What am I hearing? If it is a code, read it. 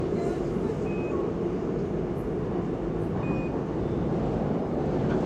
Quindar tones, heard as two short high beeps, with room echo and the noise inside a subway train.